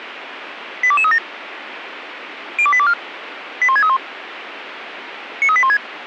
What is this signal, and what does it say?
Five-tone selective call (ZVEI), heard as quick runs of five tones, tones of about 70 ms, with radio hiss. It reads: 82237 02824 81631 93816